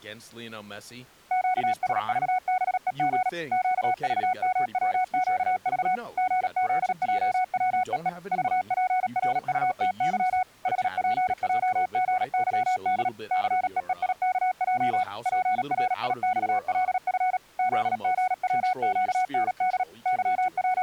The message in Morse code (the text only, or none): QSVBEG QVMWQV GZJWEE VPRUTY HPJGYD CEEIKJ PRIXLF ZGWQND …